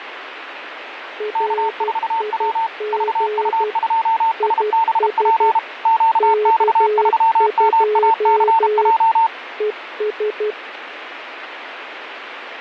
Morse code, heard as two keyed tones, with radio static. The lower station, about 12 wpm, 420 Hz: RIG IS K2 ES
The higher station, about 32 wpm, 900 Hz: K4W VU2SBP QX3MACJ